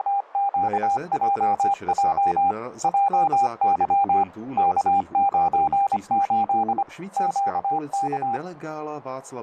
Morse code, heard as a keyed tone, machine-sent, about 25 wpm, 800 Hz, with radio static, a narrow filter and speech in Czech. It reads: … JY K98 QK